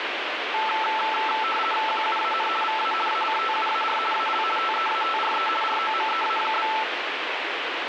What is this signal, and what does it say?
RTTY (50 baud, 450 Hz shift), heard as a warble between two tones, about 1100 Hz centre, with radio static. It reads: QUAN VA ACTUAR AL TEATRE ROMEA?